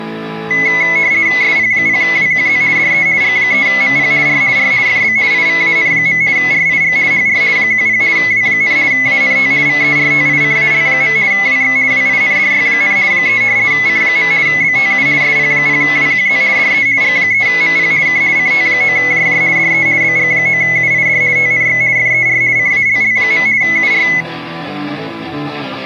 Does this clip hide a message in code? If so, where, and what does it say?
Yes: RTTY (50 baud, 170 Hz shift) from 0.5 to 24.2 s, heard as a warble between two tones, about 2100 Hz centre. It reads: SP0WQZ DE G3MP R R FB IVAN. RIG HR 10 W, ANT VERTICAL. WX WINDY, 3 C. BTU SP0WQZ DE G3MP K CT9JJ DE BG9UID TNX FER CALL. UR